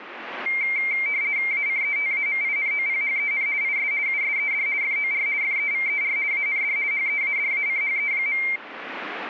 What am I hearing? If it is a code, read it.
RTTY (50 baud, 170 Hz shift), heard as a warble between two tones, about 2200 Hz centre. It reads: ACETAMINOPHEN IS USED FOR FEVER AND HEADACHE.